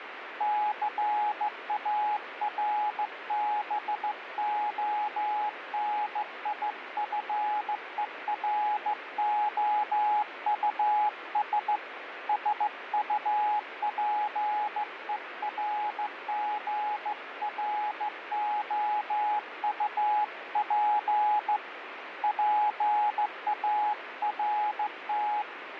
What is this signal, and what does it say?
Morse code, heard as a keyed tone, hand-sent with a straight key, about 15 wpm, 840 Hz, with radio static. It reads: CARBONIFEROUS SUPERGROUP PART